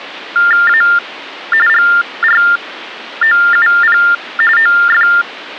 TTY/TDD text telephone tones (45.45 baud Baudot), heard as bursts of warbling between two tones, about 400 Hz shift, 1600 Hz centre. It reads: A GROUP OF